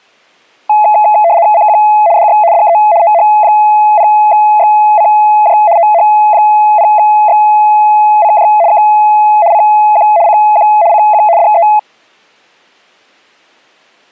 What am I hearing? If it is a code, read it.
RTTY (75 baud, 170 Hz shift), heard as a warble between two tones, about 760 Hz centre. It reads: CQ DX DE OH0XCJ OH0XCJ K CQ CQ CQ DE